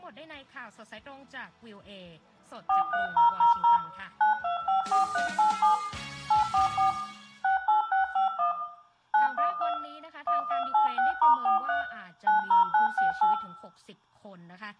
DTMF, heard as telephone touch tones, dialled by machine, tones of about 130 ms, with room echo. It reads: 43000 9254387 844 68651 912 1286*43 90968